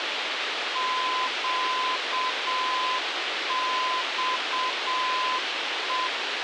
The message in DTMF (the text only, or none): none